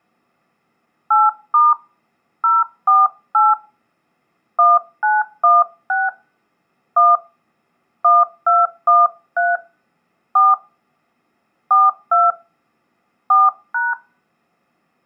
DTMF, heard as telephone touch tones, dialled by hand, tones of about 190 ms. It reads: 8* 048 1916 1 1213 4 42 4#